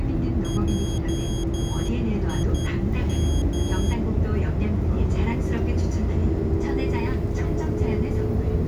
Morse code, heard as a high beeper, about 10 wpm, 3250 Hz, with the noise inside a bus. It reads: JIM